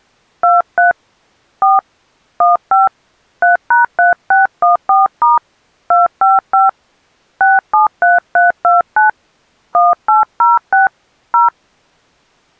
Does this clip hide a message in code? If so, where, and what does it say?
Yes: DTMF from 0.4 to 11.5 s, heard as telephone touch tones, dialled by hand, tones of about 160 ms. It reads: 23 4 15 3#3614* 255 673329 1806 0